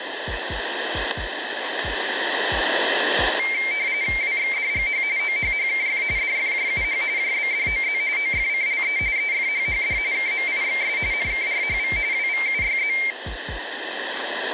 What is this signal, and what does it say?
RTTY (45.45 baud, 170 Hz shift), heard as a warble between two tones, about 2200 Hz centre. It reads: WXDGH OHHKF DFJUH JBDOZ OFCLE EFHHD KMIXS NKRHV WVUYZ